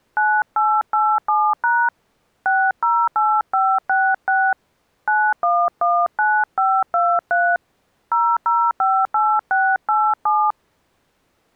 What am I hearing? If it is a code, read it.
DTMF, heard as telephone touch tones, dialled by hand, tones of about 250 ms. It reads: 9887# 608566 9119523 0058687